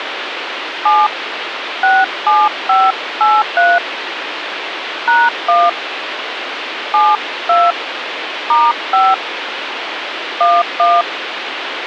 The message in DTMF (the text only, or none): 7 67583 #1 72 *5 11